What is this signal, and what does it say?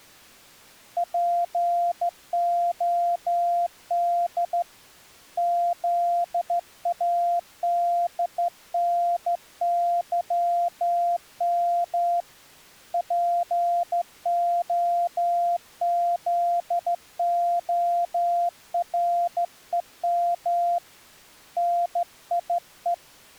Morse code, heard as a keyed tone, hand-sent with a straight key, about 14 wpm, 690 Hz. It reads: POD ZADNYM POZOREM NIE